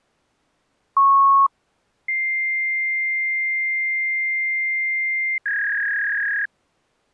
Fax machine handshake, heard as a beep, a long tone and a warble.